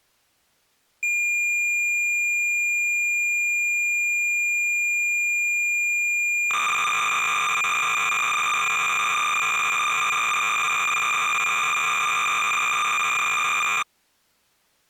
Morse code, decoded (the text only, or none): none